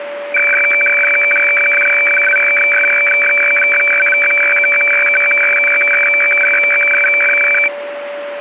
Weather fax (radiofax), 120 lines a minute, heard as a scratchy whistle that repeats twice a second, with radio static and a steady whistle near 580 Hz.